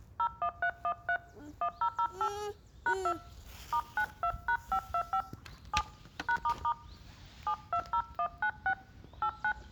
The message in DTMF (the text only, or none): 01313 1008 #2 *92#525 7 #** 720196 89